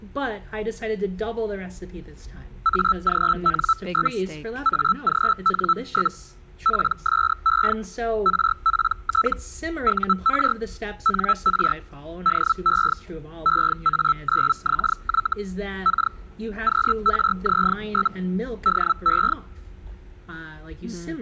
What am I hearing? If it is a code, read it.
Hellschreiber (Feld-Hell, 122.5 baud), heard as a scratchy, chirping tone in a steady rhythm, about 1320 Hz. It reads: AGN? AGN? PSE RPT UR NR DE EA9XY K QRZ? DE